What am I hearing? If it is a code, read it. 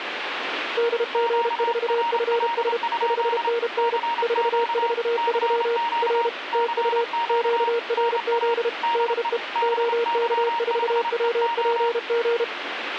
Morse code, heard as two keyed tones, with radio static. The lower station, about 32 wpm, 470 Hz: DG4FS 5NN 443 R TU QRZ DE OK4WPG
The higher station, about 28 wpm, 940 Hz: QRL? CQ CQ CQ NA DE BY5EO